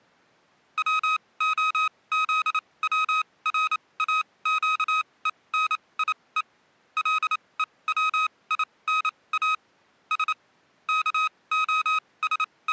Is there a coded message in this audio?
Yes: Morse code (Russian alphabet) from 0.7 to 12.7 s, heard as electronic beeps, machine-sent, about 28 wpm, spaced as for 21 wpm, 1260 Hz. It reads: ВОЗВРАЩЕНИЕ ЛЕВИНА С …